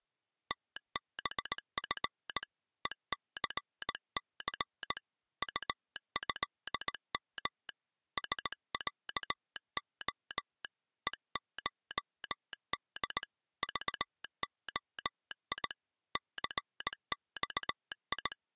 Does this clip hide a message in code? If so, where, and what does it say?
Yes: Morse code (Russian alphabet) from 0.4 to 18.4 s, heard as a telegraph sounder, hand-sent with a straight key, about 18 wpm. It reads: ТБФ ЕЦЦ УЭМ СЯО ЕШД ЖОИ ЦЬИ